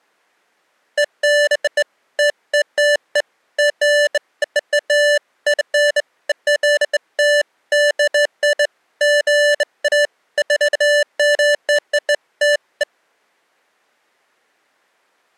Beeps of irregular length. There is no code.